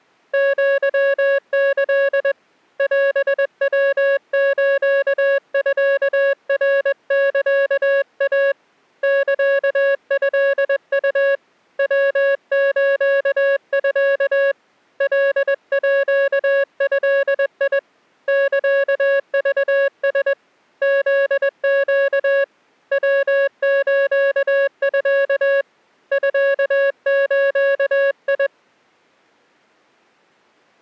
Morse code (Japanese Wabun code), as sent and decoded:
--.-- -.-.. / .-... .-- ---.- ..-.- .-. -.-.- .- / -.-.- ..-.. ..- / .-- ---.- ..-.- / .-.. .--.- ..-.. .. / -.-.- ...- ... / --.. --.- / .-- ---.- ..-.- / ..-.- ---.- ..
アキ オヤスミナサイ サトウ ヤスミ カード サクラ フネ ヤスミ ミズ

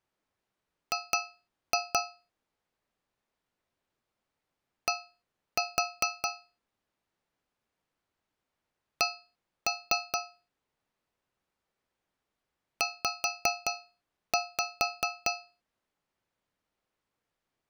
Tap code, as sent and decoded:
2-2 / 1-4 / 1-3 / 5-5
G D C Z

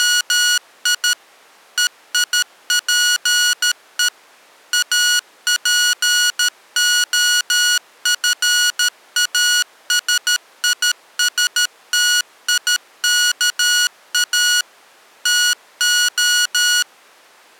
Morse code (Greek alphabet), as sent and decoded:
… / . .. .--. . / .- .--. --- ..-. .- ... .. ... - .. -.- .- / - ---
… ΕΙΠΕ ΑΠΟΦΑΣΙΣΤΙΚΑ ΤΟ

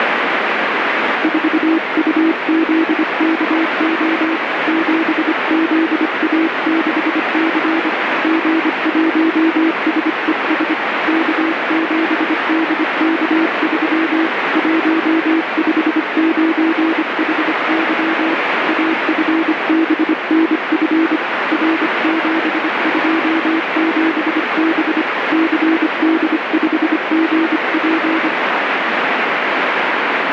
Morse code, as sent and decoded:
....- ..- --.. -.- --- / --... --.. .- -.... -.-. / --. .---- ... . ... / -.- --... -.. -.- ...-- / .---- ..... ----. .... -.-- / .- ..-. -... -. ..-. / .-. --... ..--- --... -... / -.-. -.. ..... --. .--.
4UZKO 7ZA6C G1SES K7DK3 159HY AFBNF R727B CD5GP

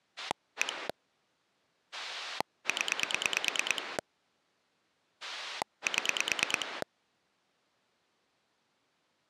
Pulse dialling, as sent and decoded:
1 / 10 / 7
1 0 7

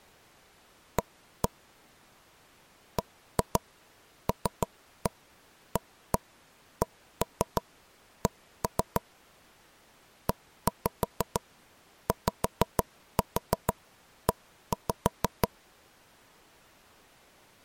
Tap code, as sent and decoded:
1-1 / 1-2 3-1 1-1 1-3 1-3 / 1-5 5-4 1-5
A BLACK EYE

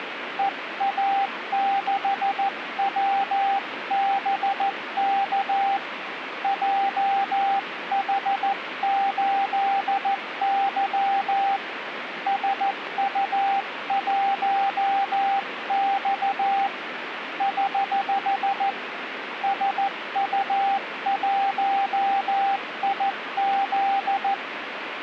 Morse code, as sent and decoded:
. .- -.... .-- -... -.- / .--- .... ---.. -.-- / ... ..- .---- -..- / ........ / ... ..- .---- .. --..
EA6WBK JH8Y SU1X <HH> SU1IZ

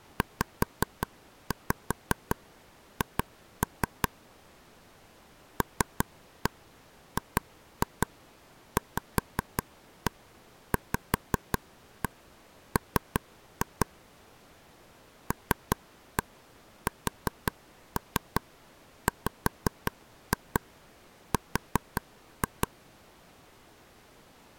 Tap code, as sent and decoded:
5-5 2-3 / 3-1 2-2 5-1 5-1 3-2 / 3-1 4-3 5-2 4-2
ZH LGVVM LSWR

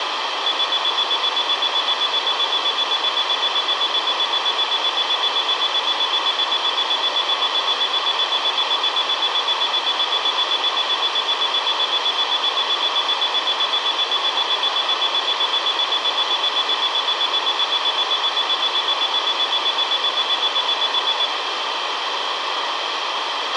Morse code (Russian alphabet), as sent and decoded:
none

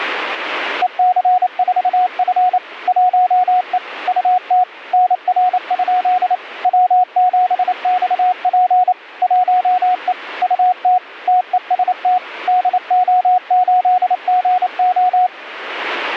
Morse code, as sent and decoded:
. -.-. ....- ..-. / .---- . / ..- - / -. .-. ..--.. / .-- --... -..- .--. / .---- . / ..- - / - . ... - / -.. --- ---.. --. ---
EC4F 1E UT NR? W7XP 1E UT TEST DO8GO

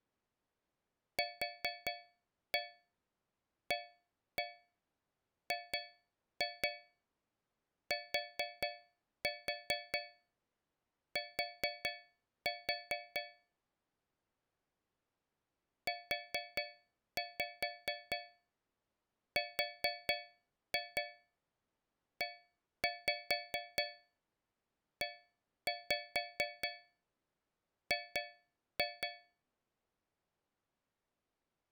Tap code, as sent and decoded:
4-1 1-1 2-2 4-4 4-4 / 4-5 4-2 1-5 1-5 2-2
QAGTT UREEG

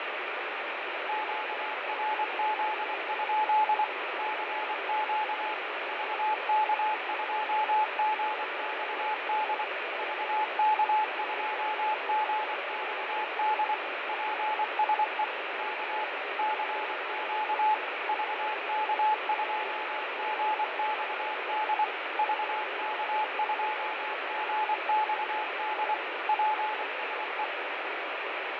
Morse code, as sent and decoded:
--.- .-. --.. ..--.. / -.-. --.- / ...- -.- ..--- --. -..- -.. / ...- -.- ..--- --. -..- -.. / .--. ... . / -.- / -.-. --.- / ...- -.- ..--- --. -..- -.. / ...- -.- ..--- --. -..- -.. / .--. ... .
QRZ? CQ VK2GXD VK2GXD PSE K CQ VK2GXD VK2GXD PSE

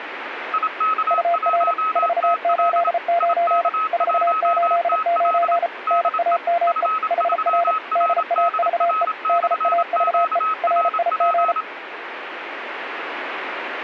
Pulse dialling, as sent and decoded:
none

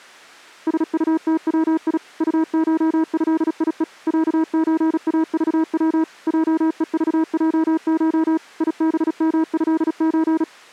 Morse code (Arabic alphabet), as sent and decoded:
... ..- - .-- .. / ..- ---- ..-.. .. . / .-.- ---. .- ...- .-- / .--- . ...- .--- ---- / .. -... -- ..-.. ---.
سطتوي طشهيء عزاضو جءضجش يبمهز

